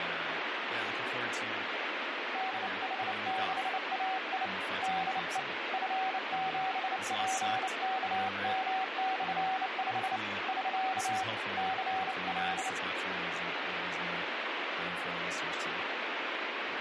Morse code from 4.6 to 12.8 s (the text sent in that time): DE F7PKM/5 <SK> CL